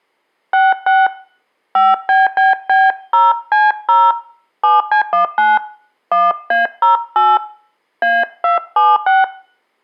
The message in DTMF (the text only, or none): 66 5BBB0C0 7C19 1A08 A276